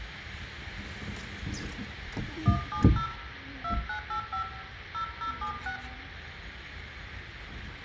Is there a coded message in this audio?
Yes: DTMF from 2.5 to 5.8 s, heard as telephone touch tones, dialled by hand, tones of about 100 ms, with radio hiss, room echo and the noise of a park. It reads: 170 2985 0076